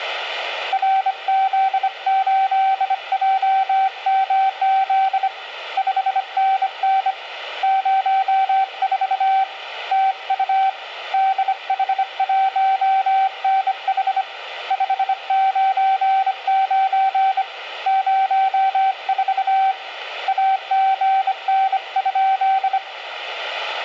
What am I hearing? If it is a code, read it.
Morse code, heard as a keyed tone, hand-sent with a bug key, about 25 wpm, 770 Hz, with radio static. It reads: RZ8JMZ 5NN 04 TU DH1NH 599 04 AGN?